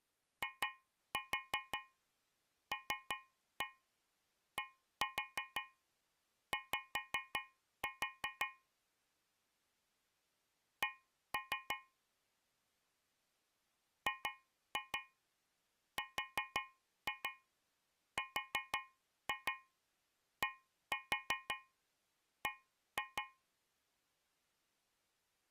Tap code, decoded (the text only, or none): ILDY C GRRDB